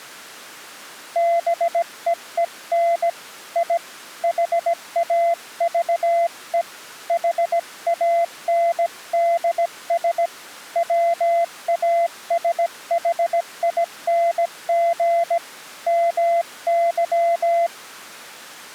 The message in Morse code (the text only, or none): BEEN I HAVE HANDS WASHING MY